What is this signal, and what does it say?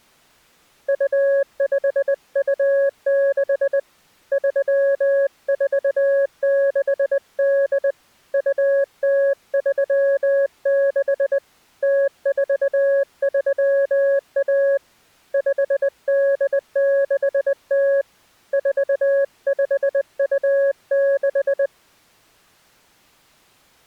Morse code (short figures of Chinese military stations), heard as a keyed tone, hand-sent with a bug key, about 20 wpm, 550 Hz. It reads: 2526 3468 2036 0431 5860 4526